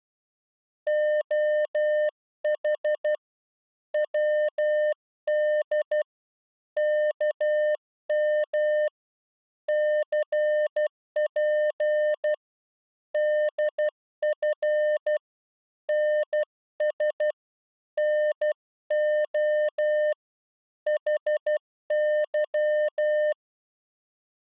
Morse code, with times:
0.9-3.1 OH
3.9-6.0 WD
6.8-8.9 KM
9.7-12.3 CP
13.1-15.2 DF
15.9-17.3 NS
18.0-20.1 NO
20.9-23.3 HY

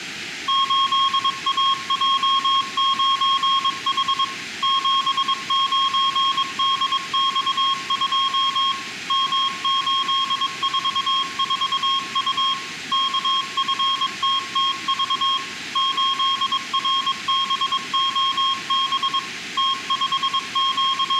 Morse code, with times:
0.5-4.2 8AJ9H
4.6-8.7 79DX2
9.1-12.5 M844U
12.9-15.4 KFTTV
15.8-19.2 8RBOB
19.6-21.2 …

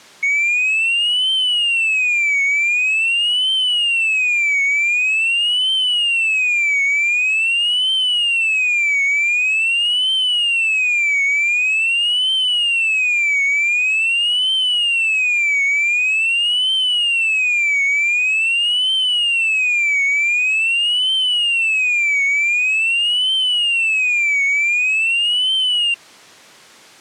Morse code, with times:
none

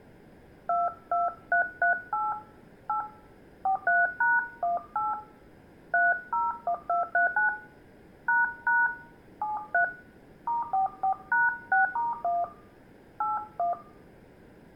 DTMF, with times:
0.7-2.3 22338
2.9-3.0 8
3.7-5.1 43#18
5.9-7.5 301239
8.3-8.9 ##
9.4-9.8 73
10.5-12.4 *44#6*1
13.2-13.7 81

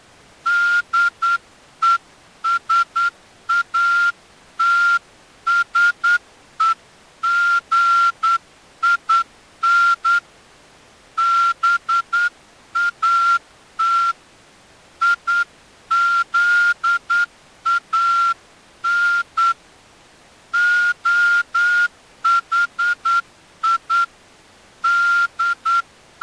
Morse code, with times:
0.5-10.2 DESATSEGIN
11.2-14.1 BAT
15.0-19.5 IZAN
20.5-24.0 OHI
24.8-26.2 …

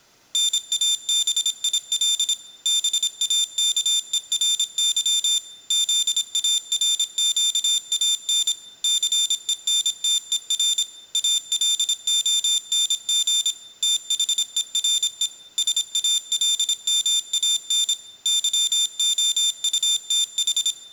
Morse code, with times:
0.3-2.3 NABIL
2.7-5.4 BAKERY
5.7-8.5 ZARQAN
8.8-10.8 CENTER
11.1-13.5 ALONG
13.8-15.3 THERE
15.6-17.9 SALMAN
18.3-20.7 YOUTH

